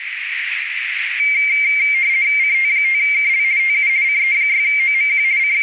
RTTY (50 baud, 170 Hz shift), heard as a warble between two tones, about 2200 Hz centre, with radio static and a narrow filter. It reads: CT5KL TU CE6OMQ …